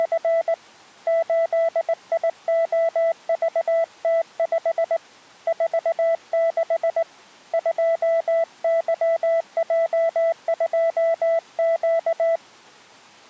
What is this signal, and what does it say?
Morse code, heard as a keyed tone, hand-sent with a straight key, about 19 wpm, 660 Hz. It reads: … 8IOVT5 46 2YJ2Q